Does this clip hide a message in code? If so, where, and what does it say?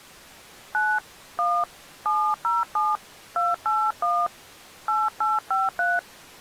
Yes: DTMF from 0.7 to 6.0 s, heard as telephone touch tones, dialled by hand, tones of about 240 ms. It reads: 9 1 707 281 8853